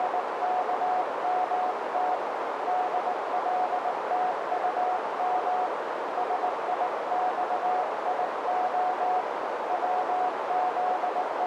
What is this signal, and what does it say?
Morse code, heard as a keyed tone, hand-sent with a paddle, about 19 wpm, 730 Hz, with heavy radio static and a narrow filter. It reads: … DLTUM SIXIO …